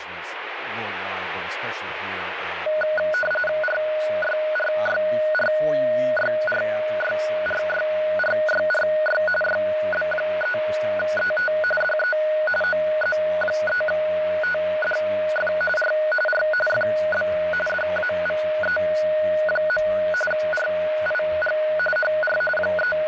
RTTY (45.45 baud, 850 Hz shift), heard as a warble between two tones, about 1040 Hz centre, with radio static. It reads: RYRYRYRYRYRYRY YB3ET DE OZ3TDF R R FB DAVE. RIG HR …